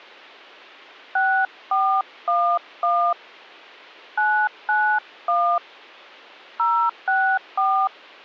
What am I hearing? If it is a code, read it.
DTMF, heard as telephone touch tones, dialled by hand, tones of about 300 ms. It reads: 6411 991 064